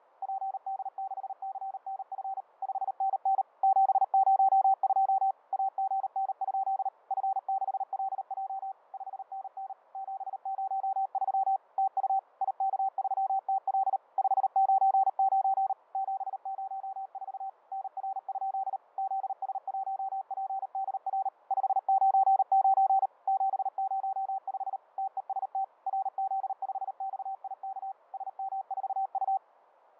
Morse code, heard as a keyed tone, machine-sent, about 38 wpm, 770 Hz, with fading. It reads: PD6CNF 5NN 702 AGN? F6LJ 5NN 703 TU IK3TL 599 704 NR? ZS1PDR 599 705 TEST RZ5XIK SM4U